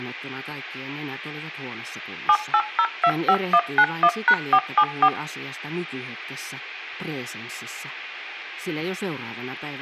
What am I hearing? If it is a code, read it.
DTMF, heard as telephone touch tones, dialled by machine, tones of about 60 ms, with speech in Finnish. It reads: 78025191#474